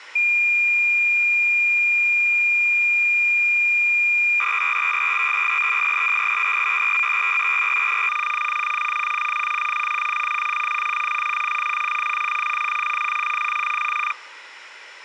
Cassette data (Kansas City type), 300 baud, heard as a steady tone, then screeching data.